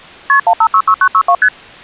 Multi-frequency trunk signalling (R1, as on North American trunks), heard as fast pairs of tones, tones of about 70 ms. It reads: KP 1566962 ST